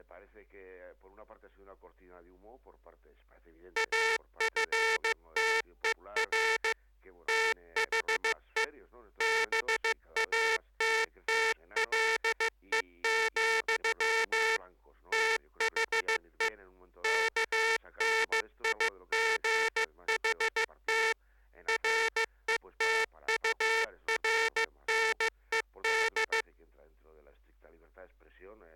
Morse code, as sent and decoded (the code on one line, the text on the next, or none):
.- ..-. - . .-. / - .... . / -... .- - - .-.. . --..-- / - .... . / -.- -. .. --. .... - / .-. . - ..- .-. -. . -..
AFTER THE BATTLE, THE KNIGHT RETURNED